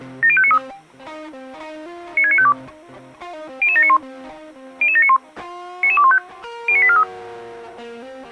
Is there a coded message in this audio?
Yes: five-tone selective call (ZVEI) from 0.2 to 7.0 s, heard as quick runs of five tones, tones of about 70 ms. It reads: 70593 96952 00791 00791 99215 09843